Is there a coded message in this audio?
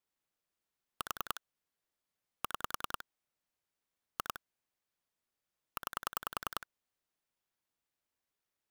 Yes: pulse dialling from 1.0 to 6.6 s, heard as clicks on a phone line, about 10 pulses a second. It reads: 4 6 2 9